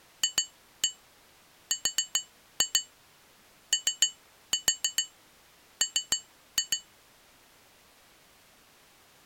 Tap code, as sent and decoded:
2-1 4-2 3-4 3-2
FROM

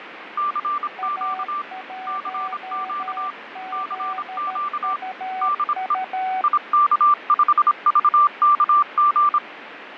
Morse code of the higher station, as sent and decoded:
-.-. --.- / -.-. --.- / -.-. --.- / -.. . / .. -.- ..... ...- -.- --.
CQ CQ CQ DE IK5VKG

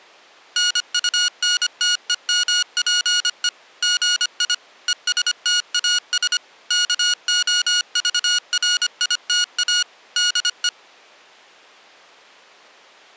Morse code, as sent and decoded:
-. ..- -. - . -- .--. . / --. .. / . ... - .- ... / -.- --- ...- .-. .. - .- / -.. .
NUNTEMPE GI ESTAS KOVRITA DE

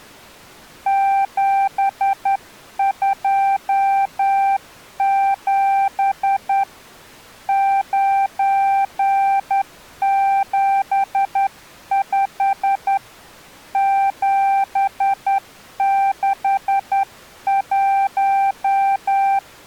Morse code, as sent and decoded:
--... ..--- --... / ----. --... ..... / --... -.... .----
727 975 761

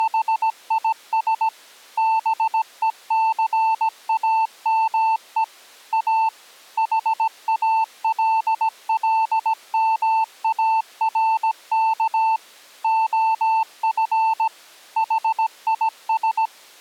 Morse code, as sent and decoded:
… / -... . -.-. .- -- . / .- / .... .- .-.. .-.. -- .- .-. -.- / --- ..-. / .... .. ...
… BECAME A HALLMARK OF HIS

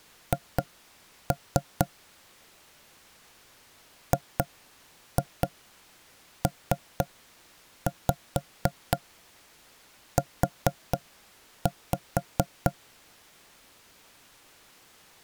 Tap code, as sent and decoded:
2-3 / 2-2 3-5 4-5
H GPU

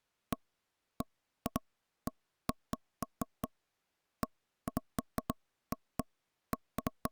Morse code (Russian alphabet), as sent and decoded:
none

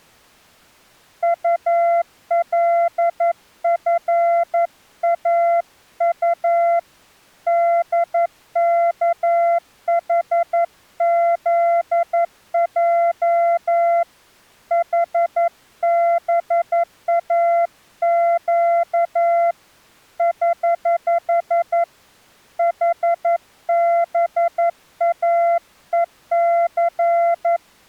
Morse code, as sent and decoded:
..- .-.. ..-. .- ..- / -.. -.- .... --.. .--- / .... -... .- --.- / ........ / .... -... .- . -.-.
ULFAU DKHZJ HBAQ <HH> HBAEC

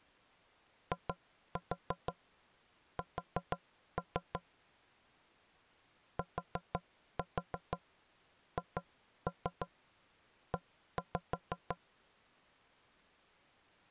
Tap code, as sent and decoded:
2-4 4-3 / 4-4 2-3 1-5
IS THE

